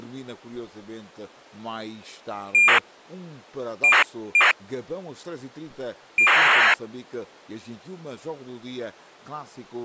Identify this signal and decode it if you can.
ACARS aircraft data, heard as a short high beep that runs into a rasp, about 2400 baud.